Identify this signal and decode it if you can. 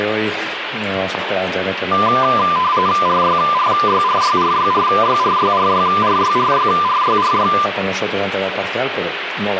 RTTY (45.45 baud, 170 Hz shift), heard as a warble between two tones, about 1100 Hz centre, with radio static. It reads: RYRYRYRYRYRYRYRYRYRYRY